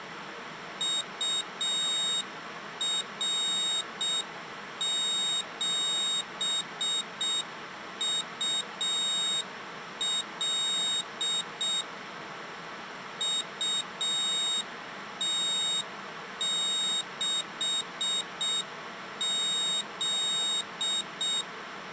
Morse code, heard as a high beeper, machine-sent, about 6 wpm, 3750 Hz. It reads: UR7UL UT6Z